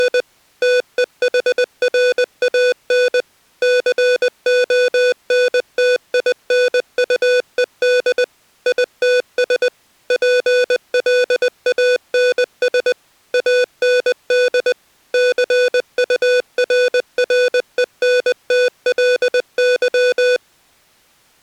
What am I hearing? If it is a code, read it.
Morse code, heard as electronic beeps, machine-sent, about 20 wpm, 500 Hz. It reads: … TEHRAN CONTINUED ITS PLANS AND CURRENTLY